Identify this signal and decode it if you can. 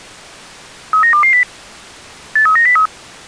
Five-tone selective call (CCIR), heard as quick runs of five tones, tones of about 100 ms. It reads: 39220 83903